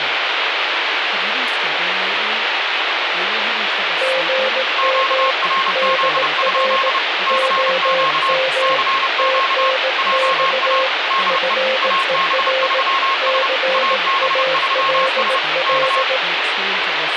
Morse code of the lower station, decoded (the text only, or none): GM DR OM TNX FER CALL